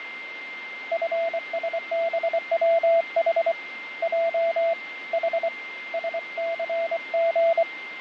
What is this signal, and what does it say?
Morse code, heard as a keyed tone, hand-sent with a paddle, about 24 wpm, 670 Hz, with radio static, fading and a steady whistle near 2100 Hz. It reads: FSBWH J H SCG